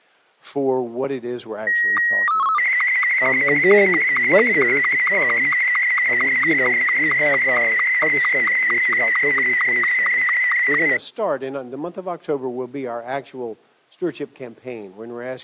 SSTV (slow-scan television), Martin M2, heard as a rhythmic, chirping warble.